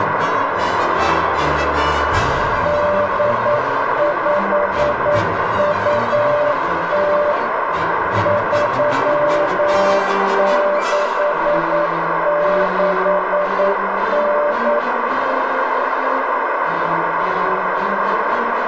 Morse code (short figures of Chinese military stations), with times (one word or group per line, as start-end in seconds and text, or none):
2.7-7.3 8520
8.3-14.8 3669